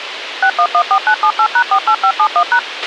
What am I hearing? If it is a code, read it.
DTMF, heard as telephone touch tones, dialled by machine, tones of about 70 ms, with radio hiss and a squelch burst at the end. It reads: 6114978#48571#